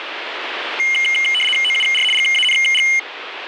RTTY (75 baud, 850 Hz shift), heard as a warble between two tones, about 2550 Hz centre, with radio static. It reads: OUR GANG